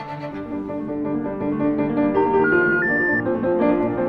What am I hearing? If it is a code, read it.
Telephone call progress tone (North American plan), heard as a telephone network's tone, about 910, 1430, 1800 Hz. Special information tone.